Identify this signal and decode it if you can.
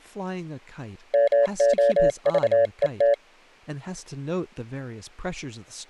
Morse code (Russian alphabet), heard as a keyed tone, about 28 wpm, 570 Hz, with speech in English. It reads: МОЖЕТ